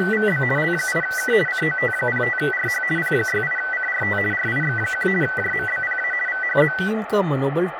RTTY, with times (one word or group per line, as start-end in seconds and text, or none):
0.0-0.4 …
0.6-1.3 L8K
1.5-2.8 COT05RH
3.0-4.2 P68CRT
4.3-5.1 RIX1
5.2-6.1 JMBPA
6.3-6.7 VHZ